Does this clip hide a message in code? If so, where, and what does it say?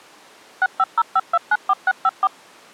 Yes: DTMF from 0.6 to 2.3 s, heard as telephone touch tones, dialled by machine, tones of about 40 ms. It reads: 6505294654